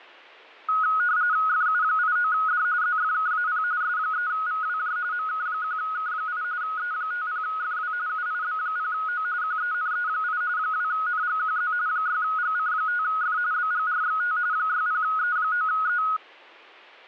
RTTY (45.45 baud, 170 Hz shift), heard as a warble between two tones, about 1360 Hz centre. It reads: FU89D ZFKAP S3VWJ MK1K8 E50FW UIB0O QENE8 2NGQZ 6GC5F BGRXT 60E9E